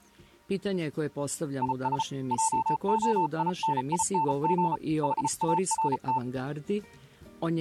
Morse code, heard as a keyed tone, hand-sent with a paddle, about 34 wpm, 890 Hz. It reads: IS JOINING HART